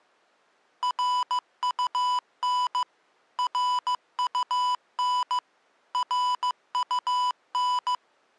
Morse code, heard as electronic beeps, machine-sent, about 15 wpm, 990 Hz. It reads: RUN RUN RUN